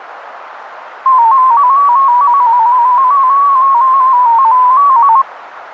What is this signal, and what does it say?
Multi-tone FSK (Olivia or MFSK type), about 250 Hz wide, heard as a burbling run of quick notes, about 15.625 baud, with radio static.